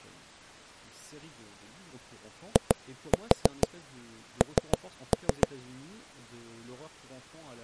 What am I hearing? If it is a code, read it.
Tap code, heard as knocks on wood, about 6 knocks a second, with speech in French. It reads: IN